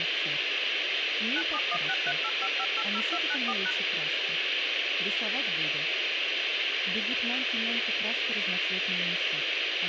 DTMF, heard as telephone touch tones, dialled by machine, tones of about 50 ms, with radio hiss. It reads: 9716385580294#